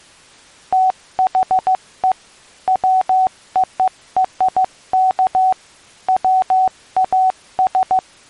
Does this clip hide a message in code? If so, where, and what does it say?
Yes: Morse code (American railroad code) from 0.7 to 8.0 s, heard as a keyed tone, machine-sent, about 750 Hz. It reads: THE WORK WAS